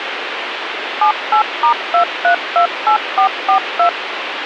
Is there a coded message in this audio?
Yes: DTMF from 1.0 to 3.9 s, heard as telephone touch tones, dialled by machine, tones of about 100 ms, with radio hiss. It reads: 78*2328442